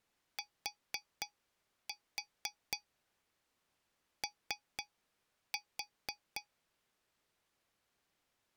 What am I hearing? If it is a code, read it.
Tap code, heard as taps on a metal pipe, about 4 knocks a second. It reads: TO